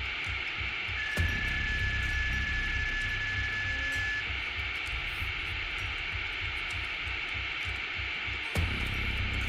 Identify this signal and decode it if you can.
PSK31 (31.25 baud), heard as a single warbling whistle, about 1700 Hz, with radio static.